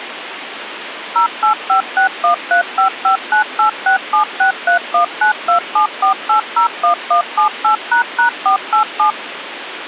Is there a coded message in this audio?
Yes: DTMF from 1.2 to 9.1 s, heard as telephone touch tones, dialled by machine, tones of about 110 ms, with phone line noise. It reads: 0856135598676319274801178##487